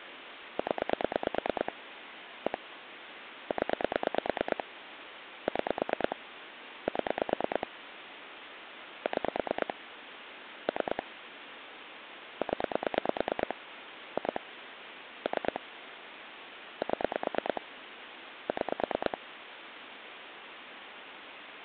Pulse dialling, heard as clicks on a phone line, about 9 pulses a second, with phone line noise. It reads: 0 1 0 6 7 6 3 0 2 3 7 6